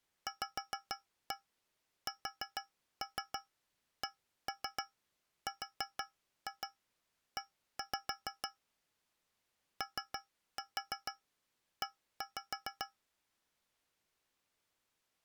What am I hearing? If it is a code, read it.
Tap code, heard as taps on a metal pipe, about 6 knocks a second. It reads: VSCRE OE